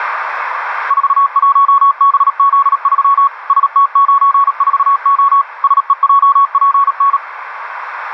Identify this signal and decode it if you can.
Morse code, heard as a keyed tone, machine-sent, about 37 wpm, 1110 Hz, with radio static. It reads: 41BZ3 ST94O SEJPN